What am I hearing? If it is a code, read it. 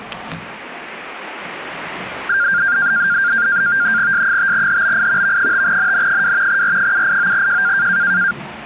NAVTEX (SITOR-B), 100 baud, 170 Hz shift, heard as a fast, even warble, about 1500 Hz centre, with the noise of a crowd indoors. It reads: S5HBI V5NN2 R789J